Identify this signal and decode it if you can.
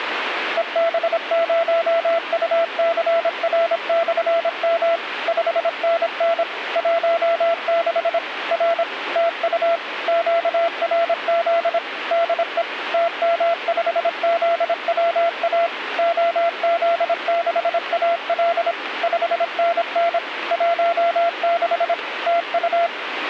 Morse code, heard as a keyed tone, machine-sent, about 26 wpm, 680 Hz, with radio static. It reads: EB0UCR/M 5NN 16 R TU QRZ DE TM5ZWA OZ6AL 5NN 16 TU